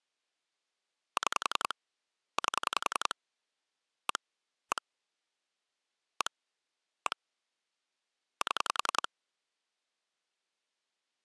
Pulse dialling, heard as clicks on a phone line, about 10 pulses a second. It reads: 6 8 1 1 1 1 7